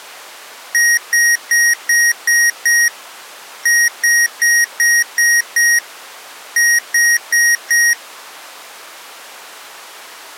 Beep code, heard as beeps from a small speaker, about 1900 Hz. 6-6-4.